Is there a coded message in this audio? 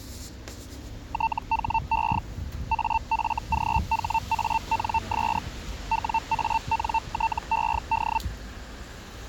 Yes: Hellschreiber (Feld-Hell, 122.5 baud) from 1.1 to 8.2 s, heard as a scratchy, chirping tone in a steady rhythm, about 900 Hz, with street noise. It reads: THE AFGHANS WANTED